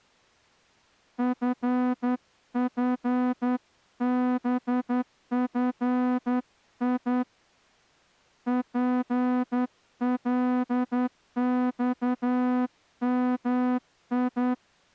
Morse code, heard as a horn, hand-sent with a straight key, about 10 wpm. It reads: FFBFI PLXMI